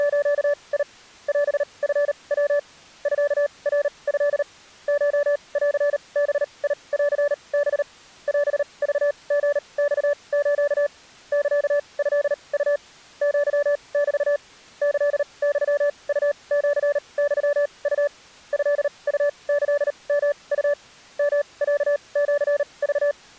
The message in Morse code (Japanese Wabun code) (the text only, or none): … オチヤ ミナト コンバンハ オクリマス サトウ アメ キユウシユウ トウキヨウ ヨロシク